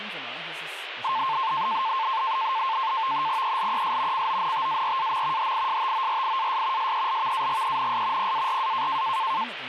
NAVTEX (SITOR-B), 100 baud, 170 Hz shift, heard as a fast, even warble, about 980 Hz centre, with radio static and speech in German. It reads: ELES CONTARAM HISTORIAS SELVAGENS PARA